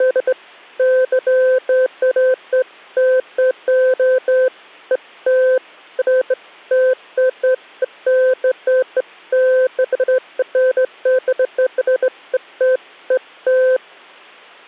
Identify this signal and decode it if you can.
Beeps of irregular length. There is no code.